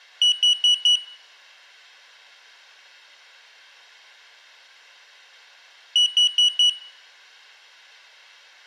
Alarm pattern, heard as an alarm's beeps, played twice, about 2950 Hz, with room echo. Temporal four. Carbon monoxide.